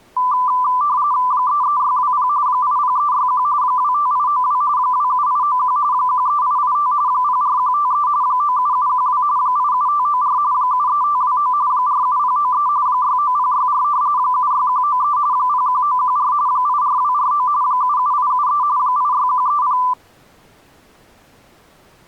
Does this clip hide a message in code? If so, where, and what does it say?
Yes: RTTY (45.45 baud, 170 Hz shift) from 0.2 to 19.9 s, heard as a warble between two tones, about 1090 Hz centre. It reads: 33620 80361 25892 27891 13885 04153 97712 87594 73529 47093 69064 76193 01914 84249 77873 86130